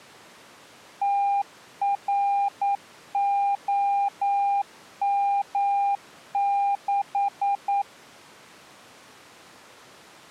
Morse code, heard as a keyed tone, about 9 wpm, 800 Hz. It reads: TROM6